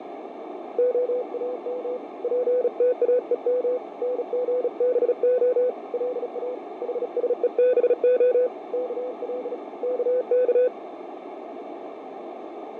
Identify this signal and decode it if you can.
Morse code (Hebrew alphabet), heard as a keyed tone, hand-sent with a bug key, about 36 wpm, 500 Hz, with radio static, fading and a narrow filter. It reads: האם פתאום נגבה לא חשובה כל כך